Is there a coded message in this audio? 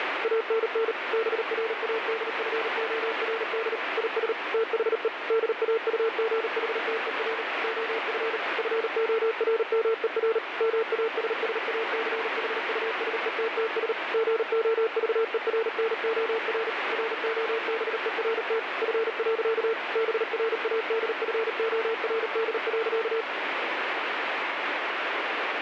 Yes: Morse code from 0.2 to 23.3 s, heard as a keyed tone, machine-sent, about 38 wpm, 450 Hz, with heavy radio static. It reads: ANN BRADFORD IS THE DAUGHTER OF FORMER MASSACHUSETTS GOVERNOR ROBERT F. BRADFORD.